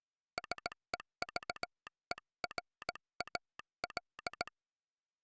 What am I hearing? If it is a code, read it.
Morse code, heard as a telegraph sounder, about 17 wpm. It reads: SEVERAL